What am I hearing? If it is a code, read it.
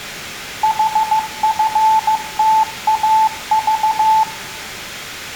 Morse code, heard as a keyed tone, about 15 wpm, 880 Hz, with room echo. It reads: HFTAV